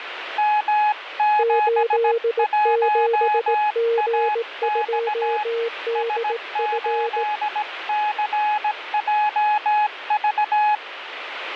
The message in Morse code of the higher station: M71AX S8CJV

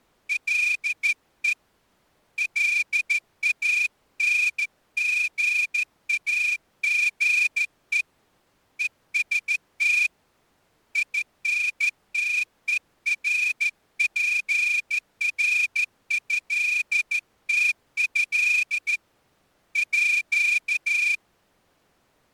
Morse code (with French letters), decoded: LE LANGAGE EST INTERPRÉTÉ À

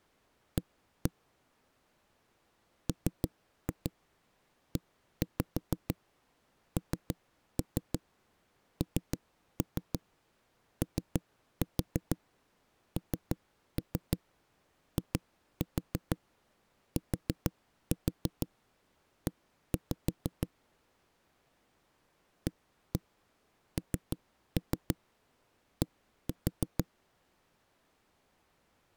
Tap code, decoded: A MENNONITE AND

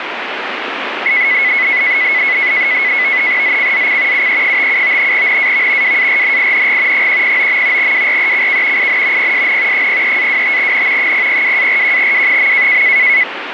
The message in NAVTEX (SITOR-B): ZCZC UE57 NAV WARNING 109. WRECK IN PSN 03-25N 002-41W.

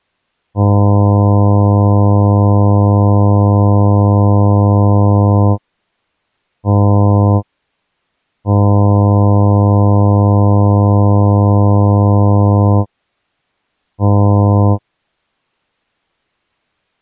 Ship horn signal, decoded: 1 long, 1 short, 1 long, 1 short

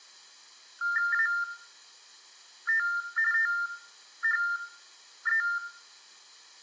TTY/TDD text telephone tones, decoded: AT THE

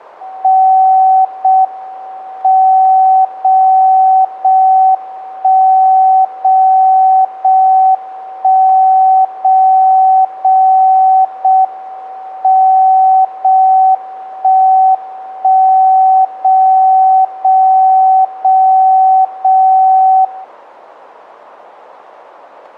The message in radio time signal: 0 M 0 0 1 0 0 1 0 0 0 M 0 1 1 0 0 0 0 0

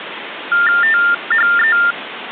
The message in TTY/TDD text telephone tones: THE

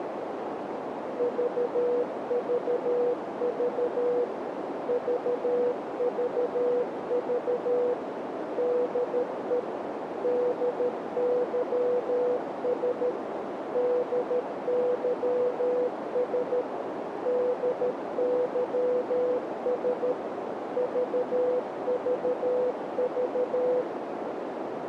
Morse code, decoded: VVV VVV DE DYS DYS DYS VVV

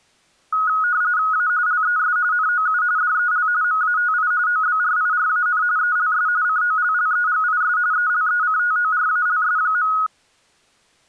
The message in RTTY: A LES NOU DEL MATI OBRIRAN ELS COLLEGIS ELECTORALS.

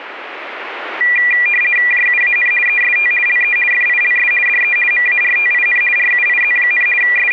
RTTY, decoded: JUAN EST LE FILS DE MARTIN RUIZ, …

